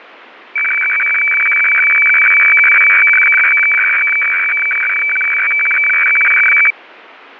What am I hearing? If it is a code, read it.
Weather fax (radiofax), 120 lines a minute, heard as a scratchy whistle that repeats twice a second, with radio static.